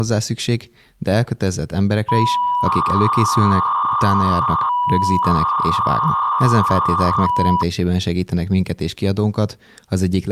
300-baud modem data (V.21 tones), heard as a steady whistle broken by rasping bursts, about 300 baud, 200 Hz shift, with speech in Hungarian.